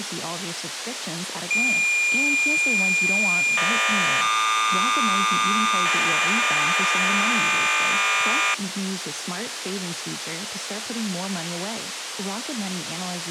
Cassette data (Kansas City type), 1200 baud, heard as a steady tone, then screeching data, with tape hiss.